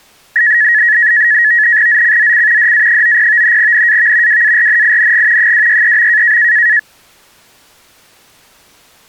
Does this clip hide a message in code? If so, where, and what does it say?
Yes: NAVTEX (SITOR-B), 100 baud, 170 Hz shift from 0.4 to 6.8 s, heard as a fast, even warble, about 1800 Hz centre. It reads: ZCZC DA90 NAV WARNING 263.